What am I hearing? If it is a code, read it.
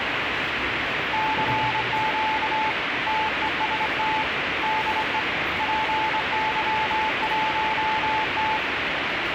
Morse code, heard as a keyed tone, hand-sent with a straight key, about 25 wpm, 870 Hz, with radio static and the noise of a subway station. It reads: CQ TEST DE PY1T